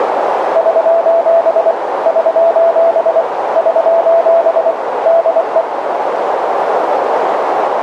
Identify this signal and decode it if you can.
Morse code, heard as a keyed tone, machine-sent, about 24 wpm, 670 Hz, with radio static and a narrow filter. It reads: <SOS> <SOS> <SOS> DE